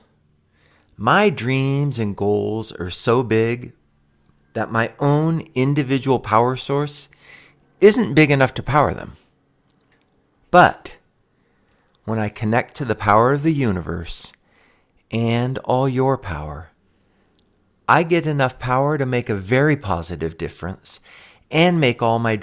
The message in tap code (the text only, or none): none